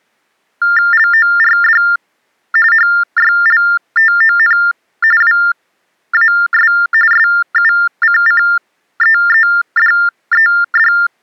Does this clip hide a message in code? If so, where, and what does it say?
Yes: TTY/TDD text telephone tones (45.45 baud Baudot) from 0.6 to 11.1 s, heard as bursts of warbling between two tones, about 400 Hz shift, 1600 Hz centre. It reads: LORD HYLTON WAS SUCCEEDED